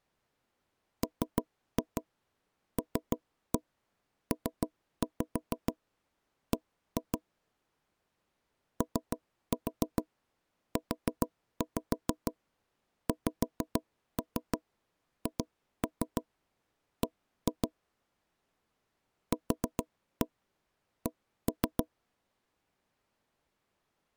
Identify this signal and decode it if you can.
Tap code, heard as knocks on wood, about 6 knocks a second. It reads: MLPB OUXHB QC